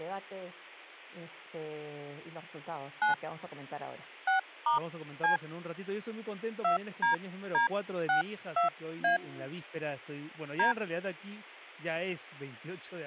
DTMF, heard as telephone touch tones, dialled by hand, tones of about 120 ms, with speech in Spanish. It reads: 9 6*C 2DD62A D